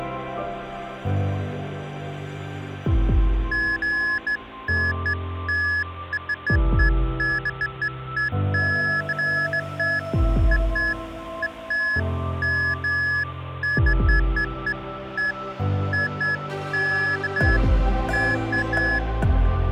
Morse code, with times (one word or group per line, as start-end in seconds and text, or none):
none